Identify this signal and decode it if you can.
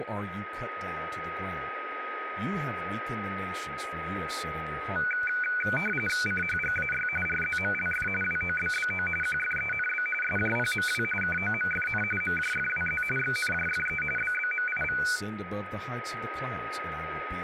RTTY (45.45 baud, 850 Hz shift), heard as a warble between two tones, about 1900 Hz centre, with radio static, a steady whistle near 1260 Hz and speech in English. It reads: CHGAY RZMLF WOBBO QFENB SJPMW KOMFN MJFWZ XNJFE BBMIV